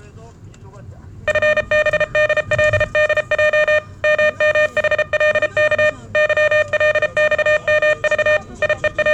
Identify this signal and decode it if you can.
Morse code, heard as electronic beeps, machine-sent, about 33 wpm, 610 Hz, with the noise inside a car. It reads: FBDLDJ MMHLK YLXMV …